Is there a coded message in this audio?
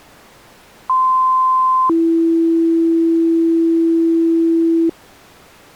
Yes: two-tone page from 0.9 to 4.9 s, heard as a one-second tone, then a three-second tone, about 1040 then 330 Hz.